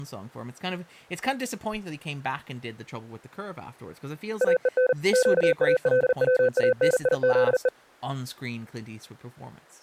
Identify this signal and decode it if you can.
Morse code (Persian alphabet), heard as a keyed tone, machine-sent, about 40 wpm, 510 Hz, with speech in English. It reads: اهن گالوانیزه